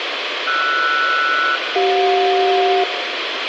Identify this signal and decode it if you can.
Aircraft SELCAL, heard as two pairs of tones, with radio hiss and room echo. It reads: RS-CJ